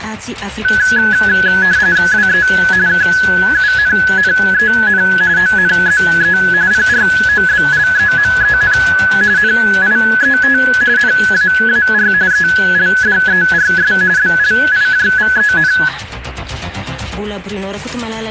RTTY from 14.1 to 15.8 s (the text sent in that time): BLIJVEN